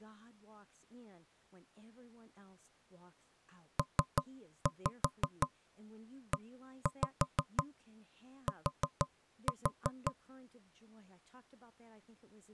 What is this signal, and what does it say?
Tap code, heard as knocks on wood, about 5 knocks a second, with speech in English. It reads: PET